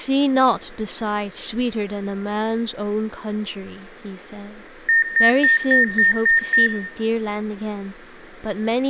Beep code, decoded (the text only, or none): 7 short